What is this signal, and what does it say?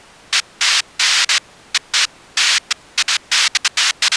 Bursts of noise. There is no code.